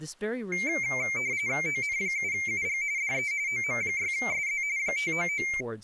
RTTY (45.45 baud, 170 Hz shift), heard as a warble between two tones, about 2200 Hz centre, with speech in English. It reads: ON7UG DE OM6SZ 599